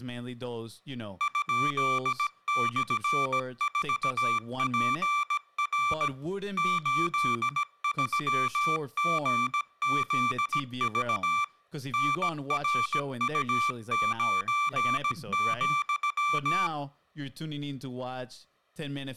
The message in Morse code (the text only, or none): ?/4PR 83GZV NRU9,